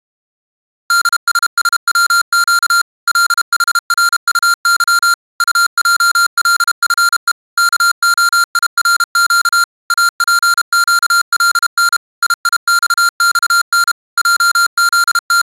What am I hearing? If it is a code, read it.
Morse code, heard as electronic beeps, machine-sent, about 32 wpm, 1390 Hz. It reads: DSSWQ LHRUY UJLFE KOIRQ APQLN IIXXN …